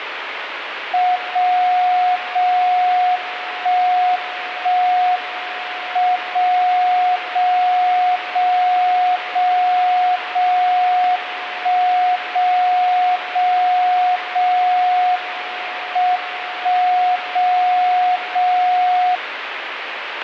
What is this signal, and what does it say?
Radio time signal (WWVB), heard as a tone whose level steps once a second, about 730 Hz, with radio static. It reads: 0 0 1 1 M 0 0 0 0 0 1 0 0 0 M 1 0 0